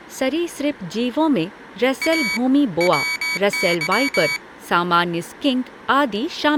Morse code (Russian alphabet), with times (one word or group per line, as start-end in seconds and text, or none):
2.0-2.4 А
2.8-4.4 ВЫ